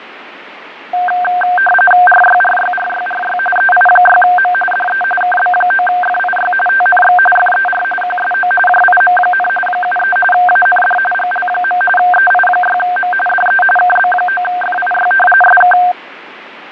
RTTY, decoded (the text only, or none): RYRYRYRY EI6M DE KB9FIY TNX FER QSO JIM, 73 AND GL. EI6M DE KB9FIY SK